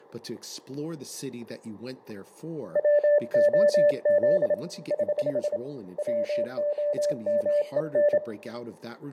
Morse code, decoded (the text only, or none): WOZ <HH> WOMEN